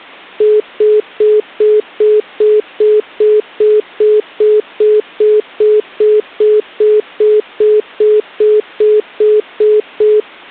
Telephone call progress tone (single-tone plan, as in most of Europe), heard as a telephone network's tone, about 420 Hz, 0.2 s on and 0.2 s off. Congestion tone.